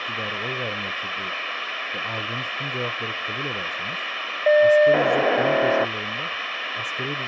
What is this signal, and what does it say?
POCSAG pager data (1200 baud), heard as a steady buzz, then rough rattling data, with radio hiss and speech in Turkish.